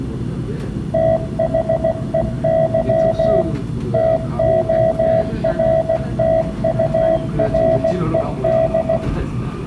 Morse code, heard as a keyed tone, machine-sent, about 16 wpm, 650 Hz, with room echo and the noise inside a subway train. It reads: THEY TORTURED